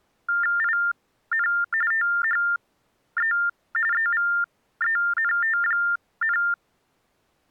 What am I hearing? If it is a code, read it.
TTY/TDD text telephone tones (45.45 baud Baudot), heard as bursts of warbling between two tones, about 400 Hz shift, 1600 Hz centre. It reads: IN THE EVENT,